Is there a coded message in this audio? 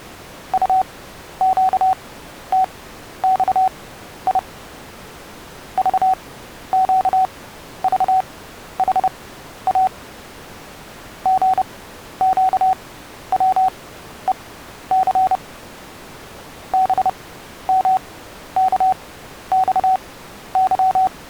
Yes: Morse code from 0.5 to 21.1 s, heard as a keyed tone, machine-sent, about 30 wpm, spaced as for 12 wpm, 750 Hz. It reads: UQTXI VQVHA GQWEC BMKXY